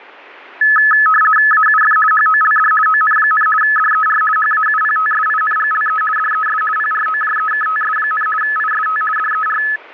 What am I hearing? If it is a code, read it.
RTTY (50 baud, 450 Hz shift), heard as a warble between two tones, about 1500 Hz centre. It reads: AUF HOLD ON, DER HAUPTSINGLE DES PROJEKTS, IST DER